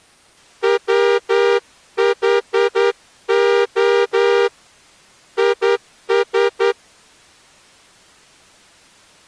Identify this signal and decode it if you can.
Morse code, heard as a horn, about 10 wpm. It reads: WHO IS